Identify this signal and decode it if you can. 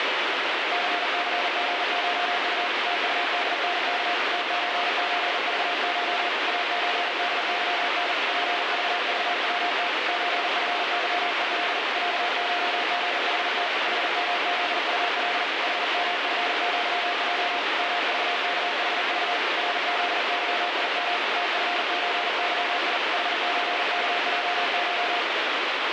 Morse code (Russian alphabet), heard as a keyed tone, hand-sent with a paddle, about 40 wpm, 710 Hz, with heavy radio static. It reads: ЦЦГШУ ТУДНК ТЧЧЖШ АЧДЫН ПЖЖВТ ЧФЫЕЛ ЯШГХТ ХМЗУЛ ХМФЪЙ МЖКХЖ РЗЫИМ ТФЧЫИ ХЧКЙШ